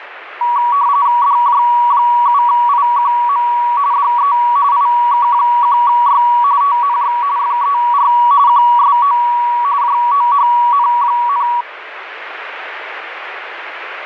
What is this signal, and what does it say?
RTTY (45.45 baud, 170 Hz shift), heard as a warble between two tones, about 1040 Hz centre, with radio static. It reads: DJ7IQM DE IK1Y TNX FER QSO JOHN,